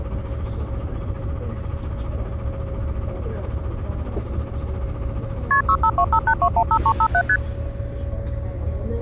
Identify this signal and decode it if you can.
Multi-frequency trunk signalling (R1, as on North American trunks), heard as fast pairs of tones, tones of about 70 ms, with the noise inside a bus. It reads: KP 65258215357 ST